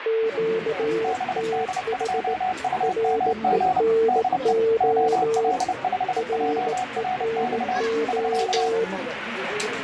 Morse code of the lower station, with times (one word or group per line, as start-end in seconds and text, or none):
0.1-2.3 QTH
2.8-5.5 RENO
6.2-8.8 RENO